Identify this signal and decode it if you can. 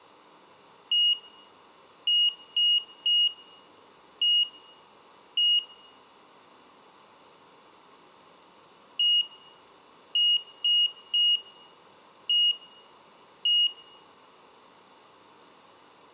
Beep code, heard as a piezo beeper, played twice, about 2850 Hz, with room echo. 1-3-1-1. In Phoenix BIOS tables: memory refresh test failure.